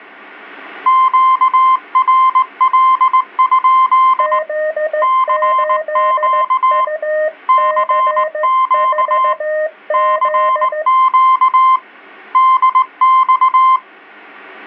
Morse code, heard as two keyed tones. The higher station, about 19 wpm, 1040 Hz: QRL? CQ CQ CQ DX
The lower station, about 15 wpm, 620 Hz: Z8UC4Z